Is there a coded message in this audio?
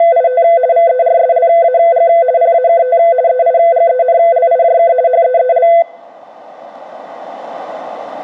Yes: RTTY (50 baud, 170 Hz shift) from 0.0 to 5.8 s, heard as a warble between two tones, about 590 Hz centre. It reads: … VERSLAG PAKT EIGENLIJK HEEL